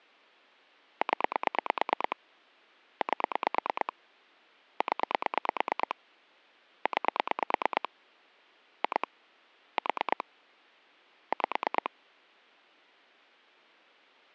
Pulse dialling, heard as clicks on a phone line, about 9 pulses a second. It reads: 0 8 0 9 2 4 5